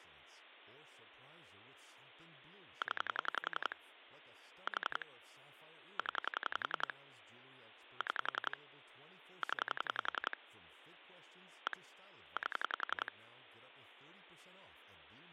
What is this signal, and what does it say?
Pulse dialling, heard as clicks on a phone line, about 11 pulses a second, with phone line noise and speech in English. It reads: 0 4 0 6 0 1 8